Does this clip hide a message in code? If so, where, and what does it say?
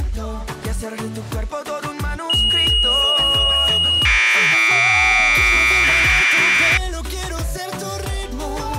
Yes: Commodore tape loading (standard loader) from 2.3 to 6.8 s, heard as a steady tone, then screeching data.